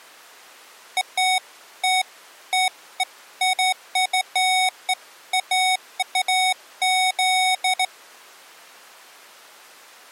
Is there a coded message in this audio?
No, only beeps of irregular length.